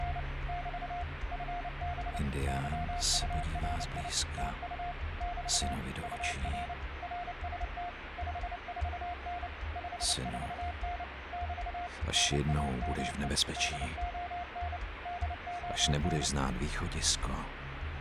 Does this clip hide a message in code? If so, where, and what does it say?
Yes: Morse code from 0.0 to 16.3 s, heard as a keyed tone, machine-sent, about 29 wpm, 710 Hz, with radio static. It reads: … <BT> FB YURI TU <BT> UR RST 54N 54N <BT> NAME DON DON